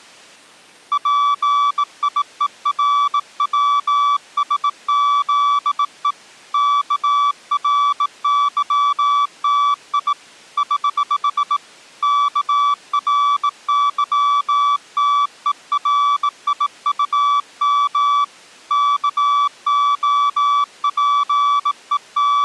Morse code, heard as a keyed tone, hand-sent with a bug key, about 18 wpm, 1150 Hz. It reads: PIERWSZE KRYTI <HH> KRYTERIUM …